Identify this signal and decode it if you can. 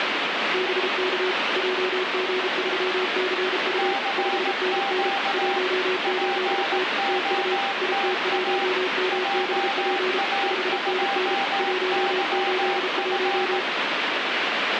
Morse code, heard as two keyed tones, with heavy radio static. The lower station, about 33 wpm, 370 Hz: BK JG3CU 5NN 18T TU IT1MBP 5NN 181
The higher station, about 18 wpm, 790 Hz: CQ POTA JA2YF